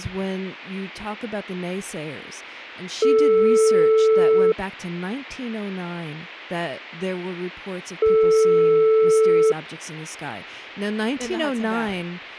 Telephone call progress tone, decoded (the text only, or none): ringback tone